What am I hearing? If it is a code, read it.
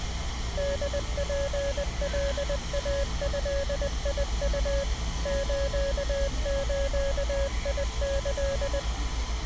Morse code (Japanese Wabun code), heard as a keyed tone, machine-sent, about 20 wpm, 560 Hz, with street noise. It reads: ホツカイドウ スズキ